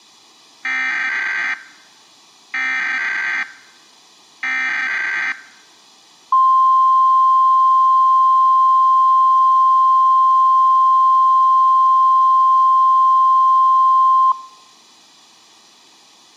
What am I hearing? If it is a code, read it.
Emergency Alert System (SAME) tones (header bursts, then the 1050 Hz attention tone), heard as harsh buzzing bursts, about 520.83 baud.